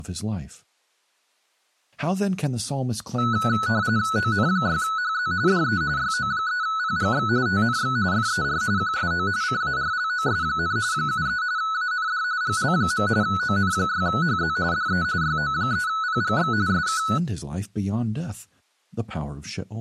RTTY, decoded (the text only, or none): ON6HZ DE YO3PGX TNX FER QSO CARLOS, 73 AND GL. ON6HZ DE YO3PGX SK